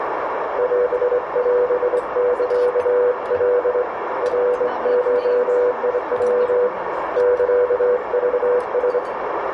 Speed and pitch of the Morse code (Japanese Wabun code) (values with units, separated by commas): 24 wpm, 490 Hz